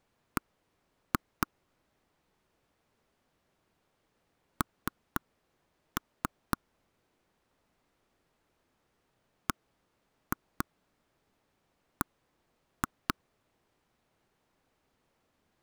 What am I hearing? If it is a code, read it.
Tap code, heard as taps on a table, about 4 knocks a second. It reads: B N BB